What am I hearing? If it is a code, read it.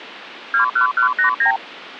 Multi-frequency trunk signalling (R2, with the far end's replies), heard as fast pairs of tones, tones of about 110 ms. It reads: 21189